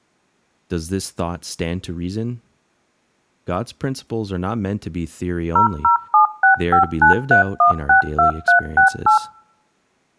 DTMF, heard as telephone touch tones, dialled by machine, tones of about 120 ms, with speech in English. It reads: 0076593162368